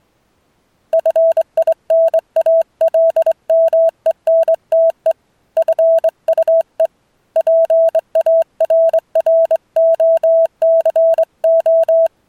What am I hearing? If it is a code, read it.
Morse code, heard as a keyed tone, hand-sent with a straight key, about 23 wpm, 660 Hz. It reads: FINALMENTE FUE PARROCO